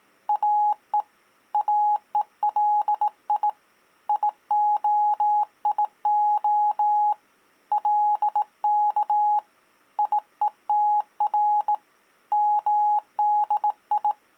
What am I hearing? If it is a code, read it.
Morse code (Hebrew alphabet), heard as a keyed tone, hand-sent with a bug key, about 18 wpm, 840 Hz. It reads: או אולי יהיה לך יותר מדי